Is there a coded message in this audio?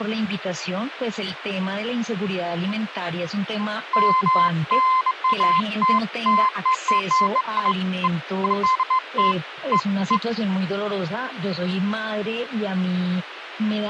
No, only beeps of irregular length.